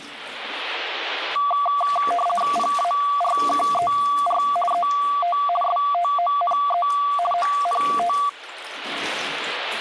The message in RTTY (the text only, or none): PARKER ET STONE ONT